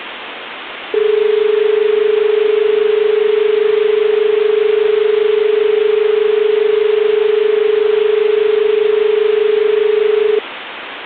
Telephone call progress tone (as in Australia), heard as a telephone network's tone, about 430 Hz, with phone line noise. Dial tone.